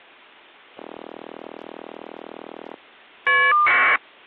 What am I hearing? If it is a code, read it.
Caller ID data burst, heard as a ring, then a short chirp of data, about 1200 baud.